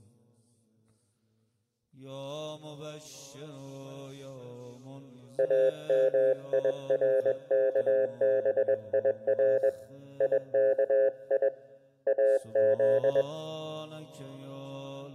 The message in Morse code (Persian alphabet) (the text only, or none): امیرکبیر یکی از